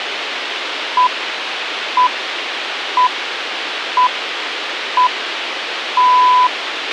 Radio time signal (six pips, as the Greenwich Time Signal), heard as pips, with radio hiss and a squelch burst at the end.